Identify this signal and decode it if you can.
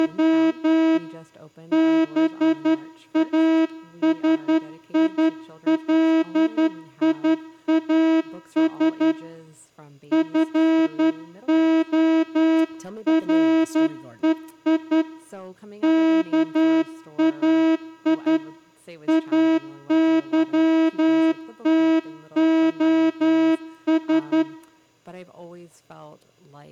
Morse code (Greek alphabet), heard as a horn, hand-sent with a straight key, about 11 wpm. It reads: … ΒΑΣΙΛΙΑΣ ΦΟΡΕΙ ΚΑΙ ΑΥΤΟΣ